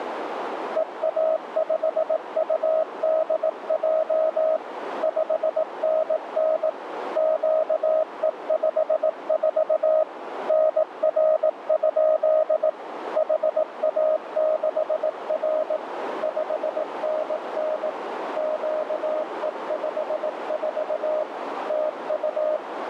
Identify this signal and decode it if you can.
Morse code, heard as a keyed tone, machine-sent, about 18 wpm, 630 Hz, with radio static and a narrow filter. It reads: EA5UDJ 5NN QE54 NR? HA6R 5NN QE54 TU